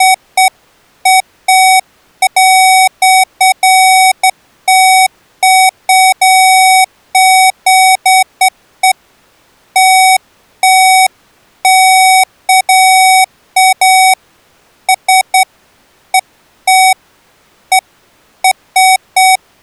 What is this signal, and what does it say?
Beeps of irregular length. There is no code.